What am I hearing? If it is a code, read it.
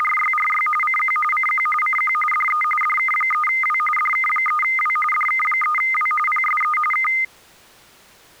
RTTY (45.45 baud, 850 Hz shift), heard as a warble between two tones, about 1650 Hz centre. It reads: … CQ CQ CQ DE DK3W DK3W DK3W PSE K